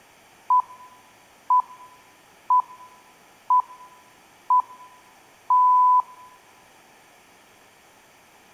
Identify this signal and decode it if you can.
Radio time signal (six pips, as the Greenwich Time Signal), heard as pips.